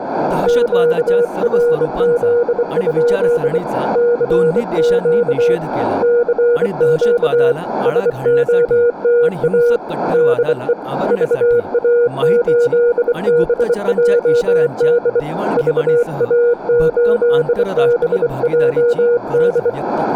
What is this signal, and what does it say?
Morse code, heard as a keyed tone, hand-sent with a bug key, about 24 wpm, 480 Hz, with radio static, a narrow filter and speech in Marathi. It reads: QRZ? CQ CQ SOTA DE VA8BJD VA8BJD